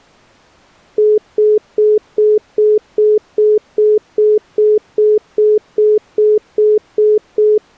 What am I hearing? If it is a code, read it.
Telephone call progress tone (single-tone plan, as in most of Europe), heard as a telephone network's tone, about 420 Hz, 0.2 s on and 0.2 s off. Congestion tone.